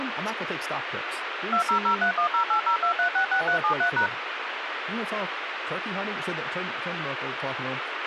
DTMF, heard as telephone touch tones, dialled by machine, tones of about 100 ms, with radio hiss, a squelch burst at the end and speech in English. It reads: 200310802366373#